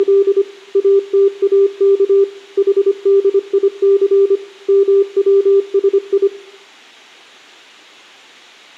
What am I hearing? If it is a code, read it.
Morse code (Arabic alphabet), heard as a keyed tone, machine-sent, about 25 wpm, 400 Hz, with room echo. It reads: … اتاك حديث موسي